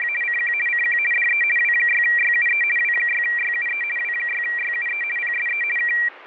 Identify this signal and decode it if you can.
RTTY (50 baud, 450 Hz shift), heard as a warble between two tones, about 2150 Hz centre. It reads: … CQ CQ DE W6YUE W6YUE W6YUE PSE K